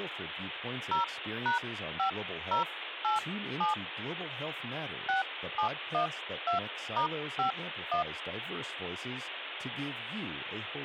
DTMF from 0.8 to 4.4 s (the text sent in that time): 0#5087